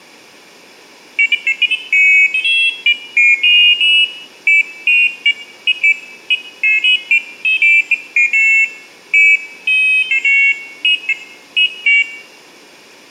Pairs of high tones at irregular times, with room echo. There is no code.